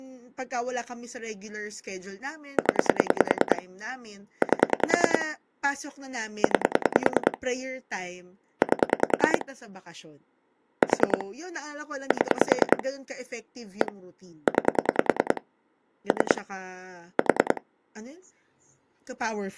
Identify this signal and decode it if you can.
Pulse dialling, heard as clicks on a phone line, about 10 pulses a second, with speech in Filipino. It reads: 0 8 9 8 4 7 1 9 3 4